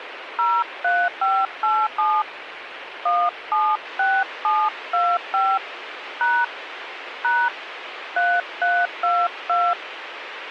DTMF, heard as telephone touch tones, dialled by hand, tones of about 240 ms, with radio hiss. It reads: 03587 176725 # # 3322